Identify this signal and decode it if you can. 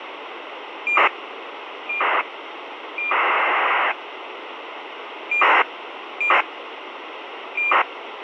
ACARS aircraft data, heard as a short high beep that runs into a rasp, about 2400 baud, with radio hiss.